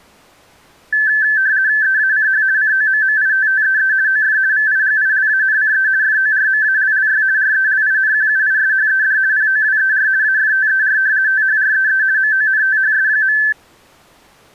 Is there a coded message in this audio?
Yes: RTTY (50 baud, 170 Hz shift) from 0.9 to 13.5 s, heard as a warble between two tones, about 1650 Hz centre. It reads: EACH COMMITTEE OF VIGILANCE FORMALLY RELINQUISHED POWER AFTER THREE MONTHS.